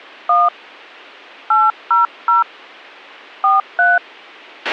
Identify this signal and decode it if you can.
DTMF, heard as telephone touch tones, dialled by hand, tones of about 180 ms, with a squelch burst at the end. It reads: 1 800 43